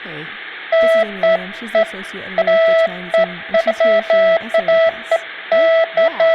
Beeps of irregular length, with speech in English. There is no code.